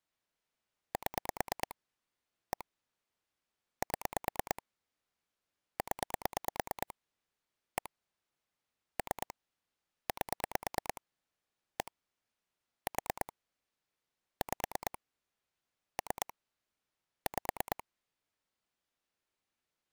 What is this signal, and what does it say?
Pulse dialling, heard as clicks on a phone line, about 9 pulses a second. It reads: 7 1 7 0 1 3 8 1 4 5 3 5